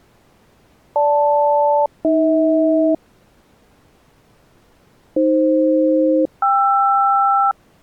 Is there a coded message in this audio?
Yes: aircraft SELCAL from 1.0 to 7.5 s, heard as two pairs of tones. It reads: GL-AH AF-KR